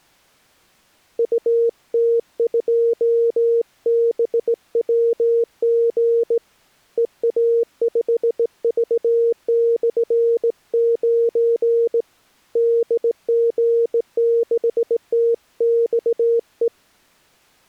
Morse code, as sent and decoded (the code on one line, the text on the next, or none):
..- - ..--- -... .-- --. / . .- ..... ...- -..-. ----. / -.. --. -.... - -..- .
UT2BWG EA5V/9 DG6TXE